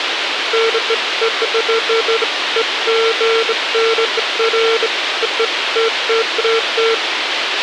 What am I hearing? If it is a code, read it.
Beeps of irregular length, with radio hiss and a squelch burst at the end. There is no code.